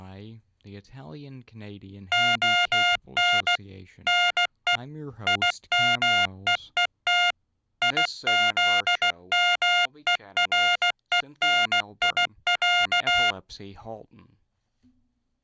Morse code (Russian alphabet), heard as electronic beeps, machine-sent, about 16 wpm, 710 Hz. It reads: ОН НЕ ИМЕЕТ ИЗМЕРЕНИЯ